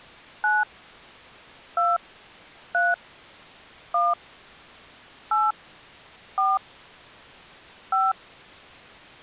DTMF, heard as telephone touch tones, dialled by hand, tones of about 200 ms. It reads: 9 2 3 1 8 4 5